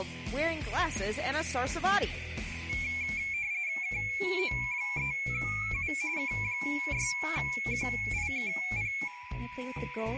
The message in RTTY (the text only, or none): KO3U K6QIKP